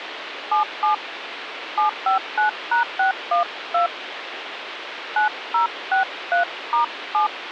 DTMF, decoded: 77 759#612 9063*7

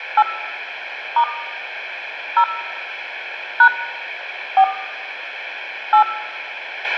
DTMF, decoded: 8 * 0 # 4 8

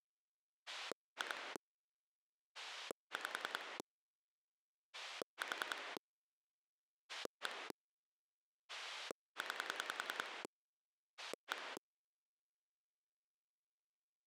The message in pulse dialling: 2 5 4 1 9 1

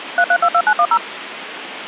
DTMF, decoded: 3322910

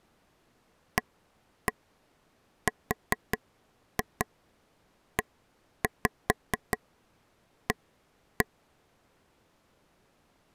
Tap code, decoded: AREA

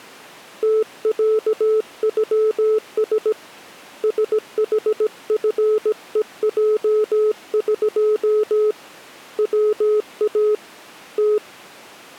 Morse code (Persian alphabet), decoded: تصغس سحفهجق وا ت

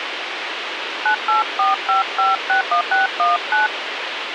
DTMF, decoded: 9845561619

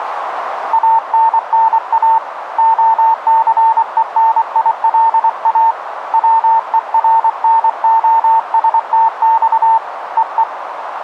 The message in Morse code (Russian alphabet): АННА ОЦЕНИЛА ВЕРНОСТЬ ЕЕ

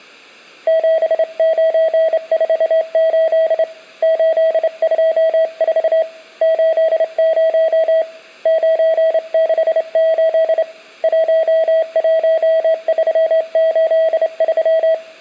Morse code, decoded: 7948 824 80 968 11383

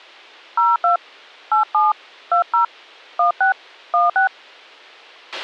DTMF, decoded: 02 87 20 16 16

